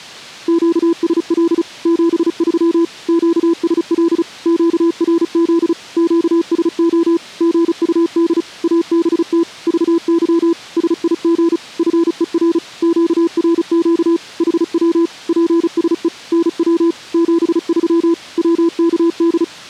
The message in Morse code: QSL 73 QSL QRZ QSO GUD ABT VY SIG FER QRQ HW PSE NW 73 WKD

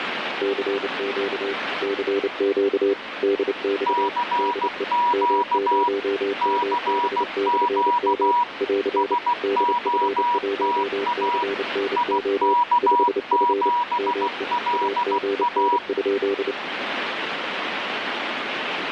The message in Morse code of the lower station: CQ CQ DX DE M0MB/M <AR> DF1CNO 5F ME AGN?

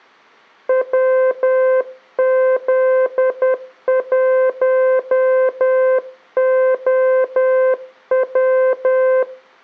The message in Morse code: WZ1OW

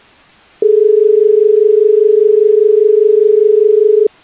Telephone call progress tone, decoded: dial tone

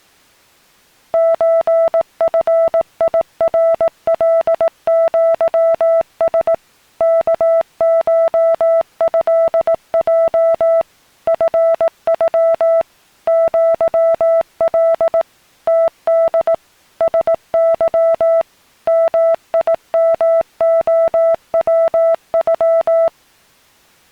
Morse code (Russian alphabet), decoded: ЧФИРЛЪС КШЭЙ ФЮ ЪЛ ТД СЫ МИМОВЮ

